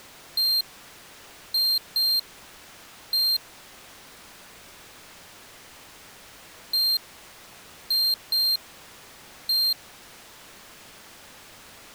Beep code, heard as a piezo beeper, played twice, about 4200 Hz. 1-2-1. In Phoenix BIOS tables: interval timer failure.